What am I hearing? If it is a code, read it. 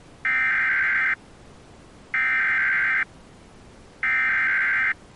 Emergency Alert System (SAME) tones (header bursts), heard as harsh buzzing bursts, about 520.83 baud.